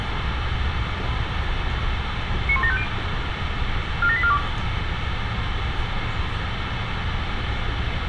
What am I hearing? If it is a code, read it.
Five-tone selective call (ZVEI), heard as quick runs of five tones, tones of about 70 ms, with radio hiss and street noise. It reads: 91750 47842